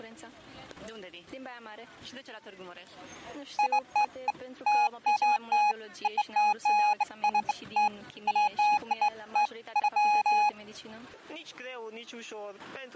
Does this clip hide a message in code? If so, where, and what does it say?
No, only beeps of irregular length.